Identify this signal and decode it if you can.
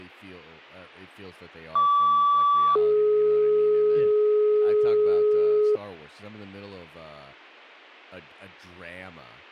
Two-tone page, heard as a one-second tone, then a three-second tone, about 1150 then 420 Hz, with speech in English.